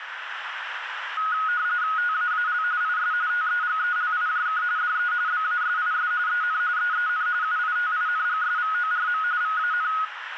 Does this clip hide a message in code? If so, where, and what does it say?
Yes: RTTY (45.45 baud, 170 Hz shift) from 1.2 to 10.1 s, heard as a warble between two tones, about 1360 Hz centre, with radio static and a narrow filter. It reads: TAAL IS TEGELIJK DE BASIS EN EEN UITINGSVORM VAN